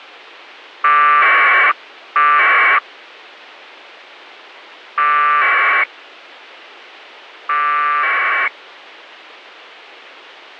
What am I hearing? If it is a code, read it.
Packet radio (AX.25, as in APRS), 1200 baud, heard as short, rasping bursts.